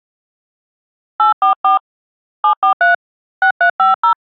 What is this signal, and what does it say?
DTMF, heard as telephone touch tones, dialled by hand, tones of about 120 ms. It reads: 844 743 6350